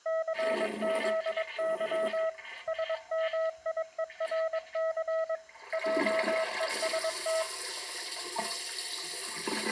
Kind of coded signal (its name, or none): Morse code